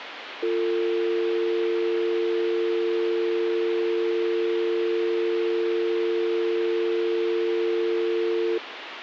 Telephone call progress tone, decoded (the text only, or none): dial tone